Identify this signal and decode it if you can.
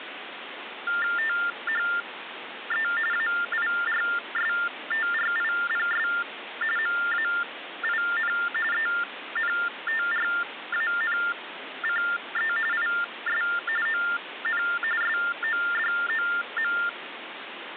TTY/TDD text telephone tones (45.45 baud Baudot), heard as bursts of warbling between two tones, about 400 Hz shift, 1600 Hz centre, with phone line noise. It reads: THE AIRSTRIPS MAIN ENTRANCE IS ON SODOM